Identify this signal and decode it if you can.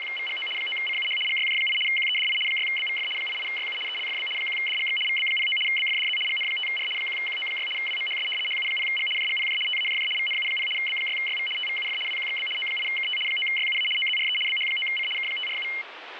RTTY (75 baud, 850 Hz shift), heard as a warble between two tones, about 2550 Hz centre, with radio static. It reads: … 9CUH GYJ8 QEDI 6BVF 88YU ELFB 1DGX VB09 BFDZ GN5R 1QO6 WMHS HU0G JGPJ TAJJ VNU0 B6YV TVUF WQXB O8KT 9YUA OZRE BH9C K547